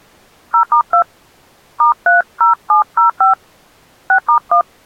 DTMF, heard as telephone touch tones, dialled by hand, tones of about 100 ms. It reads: 0*2 *30705 6*1